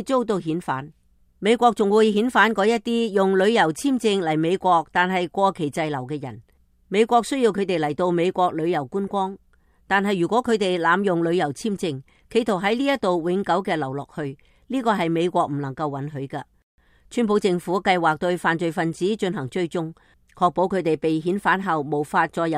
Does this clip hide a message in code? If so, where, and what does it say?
No.